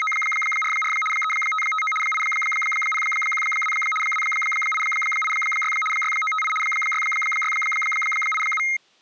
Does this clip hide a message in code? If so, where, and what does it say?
Yes: RTTY (75 baud, 850 Hz shift) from 0.0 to 8.8 s, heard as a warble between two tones, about 1700 Hz centre. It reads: … 3559 8012 2886 6958 6687